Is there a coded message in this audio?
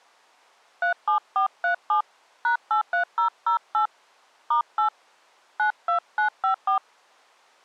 Yes: DTMF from 0.8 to 6.8 s, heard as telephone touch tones, dialled by hand, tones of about 110 ms. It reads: 37437 #83008 *8 92954